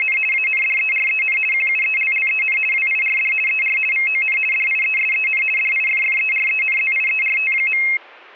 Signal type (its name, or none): RTTY